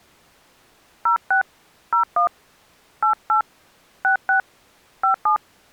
DTMF, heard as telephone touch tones, dialled by hand, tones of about 110 ms. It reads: 06 01 88 66 57